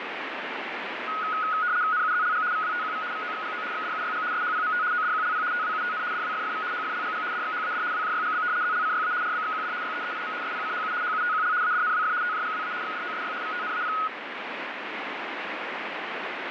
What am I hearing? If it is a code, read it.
RTTY (75 baud, 170 Hz shift), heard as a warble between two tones, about 1360 Hz centre, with radio static. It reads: NUZLG VWTQV VOXGO XDUYG SHPMT ODQLP TWUTN DWFFV HFLGG DXHAD WJYGB ZLCYA RBXQD YEEIM SPCHU HUTQL ADNWF TJGWA XDOSY VTNAP